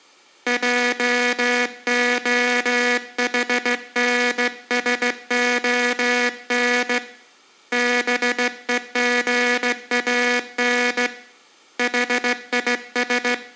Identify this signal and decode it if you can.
Morse code, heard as a buzzer, hand-sent with a straight key, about 16 wpm. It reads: JOHNSON BEGAN HIS